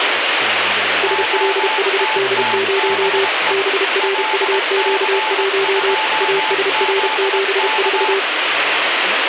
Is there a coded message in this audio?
Yes: Morse code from 1.0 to 8.3 s, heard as two keyed tones, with radio static and speech in English. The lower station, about 32 wpm, 390 Hz: SLHD0 BRUQ1 ASR74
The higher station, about 22 wpm, 870 Hz: OTTBE LC2ZK